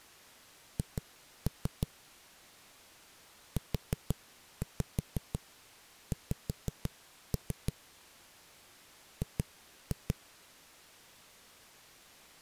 Tap code, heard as knocks on a wall, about 5 knocks a second. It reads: H UX G